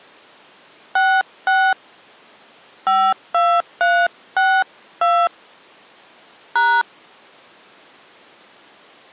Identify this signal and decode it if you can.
DTMF, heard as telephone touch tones, dialled by hand, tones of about 260 ms. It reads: 66 52362 #